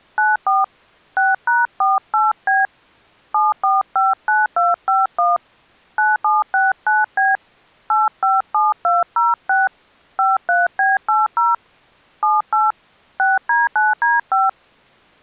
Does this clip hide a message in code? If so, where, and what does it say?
Yes: DTMF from 0.2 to 14.5 s, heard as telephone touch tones, dialled by hand, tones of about 180 ms. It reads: 94 6#48B 7459251 9769B 857206 53B80 78 6D9D5